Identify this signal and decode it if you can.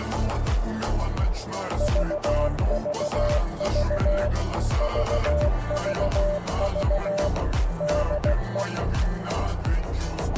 Morse code, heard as a keyed tone, machine-sent, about 16 wpm, 590 Hz, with radio static and a narrow filter. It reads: VVV VVV DE